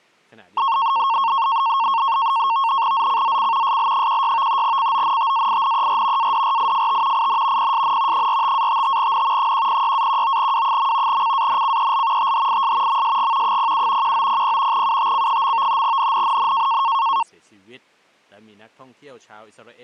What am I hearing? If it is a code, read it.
NAVTEX (SITOR-B), 100 baud, 170 Hz shift, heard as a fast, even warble, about 1000 Hz centre. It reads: ZCZC SL16 CONTAINER ADRIFT IN PSN 45-55N 106-19W. CANCEL THIS MSG 07 1900 UTC. NNNN